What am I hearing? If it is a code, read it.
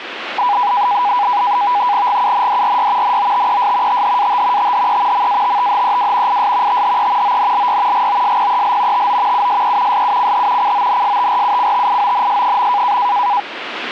NAVTEX (SITOR-B), 100 baud, 170 Hz shift, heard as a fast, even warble, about 900 Hz centre, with radio static. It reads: GUNDRY NOTES THAT THE MATTHEW IS THE ONLY GOSPEL TO USE SUCH CONSTRUCTIONS.